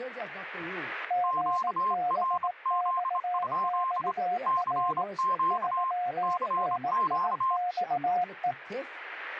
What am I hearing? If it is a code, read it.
Morse code, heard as two keyed tones, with speech in English. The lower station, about 18 wpm, 720 Hz: GBXXR 3NIXE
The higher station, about 26 wpm, 1050 Hz: QRZ? CQ CQ